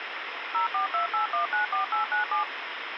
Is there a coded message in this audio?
Yes: DTMF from 0.5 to 2.4 s, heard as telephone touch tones, dialled by machine, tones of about 120 ms, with phone line noise. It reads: 0428194897